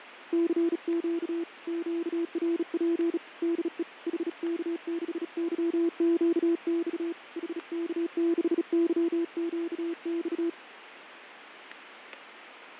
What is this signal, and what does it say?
Morse code, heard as a keyed tone, hand-sent with a bug key, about 36 wpm, 340 Hz, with radio static and fading. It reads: CQ QRP DE HK6YQX HK6YQX